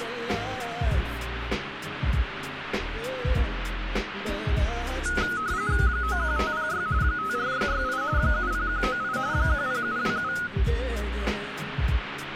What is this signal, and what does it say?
RTTY (45.45 baud, 170 Hz shift), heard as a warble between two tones, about 1360 Hz centre, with radio static. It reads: 91506 54668 70198 10727